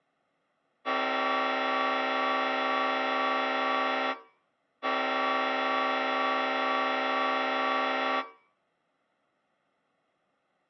Train horn signal, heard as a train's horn. 2 long. On North American railways: brakes released, proceed.